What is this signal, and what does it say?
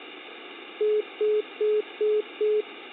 Telephone call progress tone (single-tone plan, as in most of Europe), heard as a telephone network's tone, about 420 Hz, 0.2 s on and 0.2 s off, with phone line noise. Congestion tone.